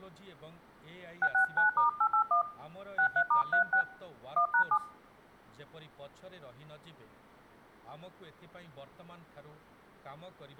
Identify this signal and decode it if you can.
DTMF, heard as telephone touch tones, dialled by hand, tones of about 90 ms, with speech in Odia. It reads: 669*881 63*36 1#7